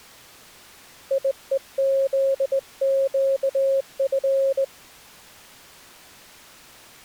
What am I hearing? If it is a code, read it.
Morse code, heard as a keyed tone, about 19 wpm, 540 Hz. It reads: IEZQF